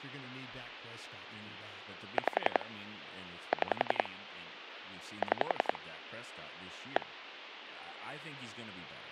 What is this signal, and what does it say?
Pulse dialling, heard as clicks on a phone line, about 11 pulses a second, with phone line noise and speech in English. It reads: 5 6 6 1